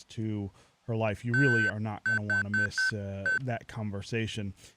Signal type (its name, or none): Morse code